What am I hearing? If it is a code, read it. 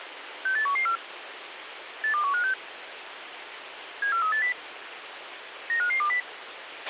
Five-tone selective call (CCIR), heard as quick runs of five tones, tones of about 100 ms, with radio hiss and a squelch burst at the end. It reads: 68114 82156 74380 95520